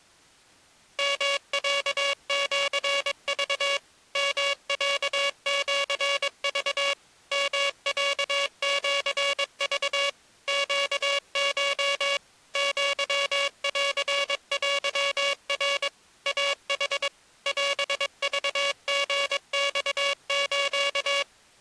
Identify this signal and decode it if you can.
Morse code (Japanese Wabun code), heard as a buzzer, machine-sent, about 22 wpm. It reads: ヨロシク ヨロシク ヨロシク ネコ アンテナ イヌ オクリマス